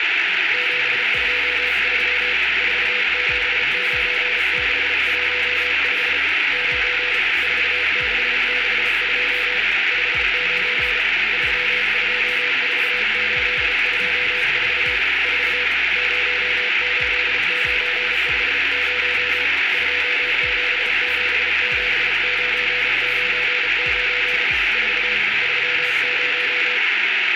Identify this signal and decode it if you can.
Morse code, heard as a keyed tone, hand-sent with a paddle, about 34 wpm, 490 Hz, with radio static. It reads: 723 479615 9 4662 59 324824 4 08950 2777999 4 30